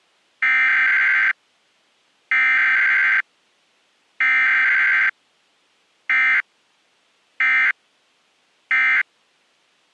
Emergency Alert System (SAME) tones (header bursts, then end-of-message bursts), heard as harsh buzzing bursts, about 520.83 baud.